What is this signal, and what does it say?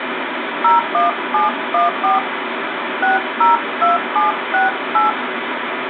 DTMF, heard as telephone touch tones, dialled by hand, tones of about 150 ms, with phone line noise. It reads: 01714 602768